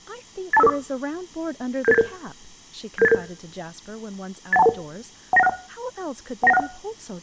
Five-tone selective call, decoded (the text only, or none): 82554 77877 77877 81211 19161 19161